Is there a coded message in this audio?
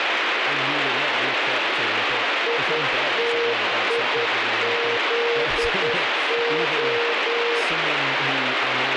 Yes: Morse code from 2.4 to 7.7 s, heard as a keyed tone, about 10 wpm, 470 Hz, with heavy radio static and speech in English. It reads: ITIZO